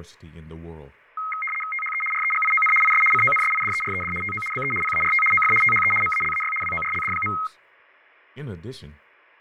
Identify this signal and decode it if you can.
RTTY (75 baud, 850 Hz shift), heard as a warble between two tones, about 1700 Hz centre, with fading and speech in English. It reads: THE REGION IS CONSIDERED TO BE PART OF THE MALAY WORLD.